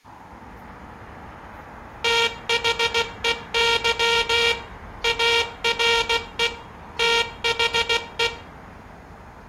Morse code, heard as a buzzer, machine-sent, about 16 wpm, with room echo and street noise. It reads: THEY ARE THE